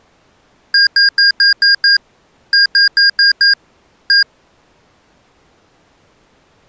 Beep code, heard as beeps from a small speaker, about 1600 Hz. 6-5-1.